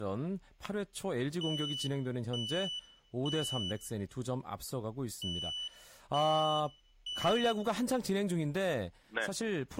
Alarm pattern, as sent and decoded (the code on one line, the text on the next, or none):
3 beeps and a pause
temporal three